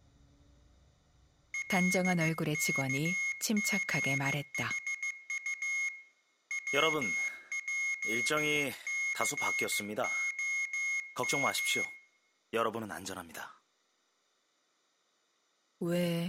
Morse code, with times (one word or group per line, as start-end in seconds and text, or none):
1.5-5.9 LKGHU
6.5-11.8 WJCOM